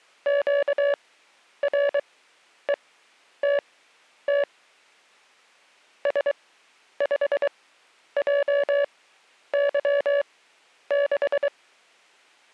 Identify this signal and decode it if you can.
Morse code, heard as a keyed tone, machine-sent, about 23 wpm, spaced as for 10 wpm, 570 Hz. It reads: QRETT S5JY6